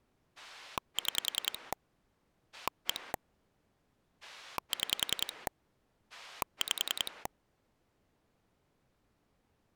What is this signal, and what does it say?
Pulse dialling, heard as a rotary dial, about 10 pulses a second. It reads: 6 1 6 5